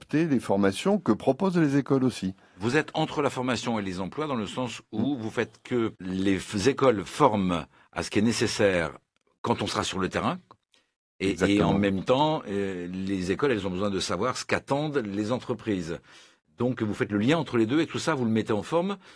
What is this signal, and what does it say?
Speech in French. There is no code.